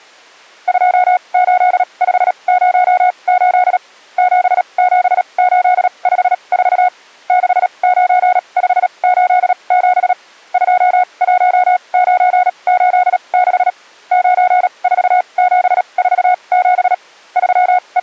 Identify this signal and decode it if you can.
Morse code, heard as a keyed tone, machine-sent, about 37 wpm, spaced as for 28 wpm, 730 Hz. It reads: 28508 77854 69587 21986 94747 …